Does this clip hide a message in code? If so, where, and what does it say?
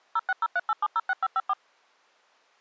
Yes: DTMF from 0.2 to 1.5 s, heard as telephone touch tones, dialled by machine, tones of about 40 ms. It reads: 06038706554